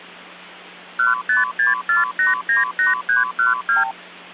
Multi-frequency trunk signalling (R2, with the far end's replies), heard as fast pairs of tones, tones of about 150 ms, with hum. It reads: 1564898312